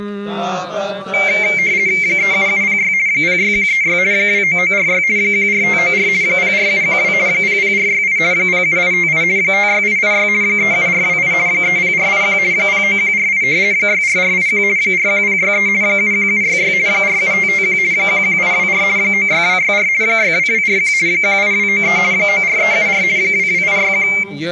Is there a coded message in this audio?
Yes: RTTY (50 baud, 170 Hz shift) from 1.1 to 24.2 s, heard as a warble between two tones, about 2200 Hz centre. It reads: 37706 06136 29946 14594 04712 00468 07858 56886 37428 30481 09148 64481 41063 71766 47551 11824 96264 62241 18293 94374 22861